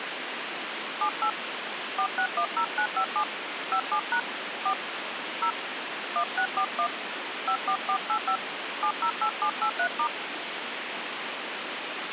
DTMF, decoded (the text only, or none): 78 4610957 57# 4 0 1641 54485 708783*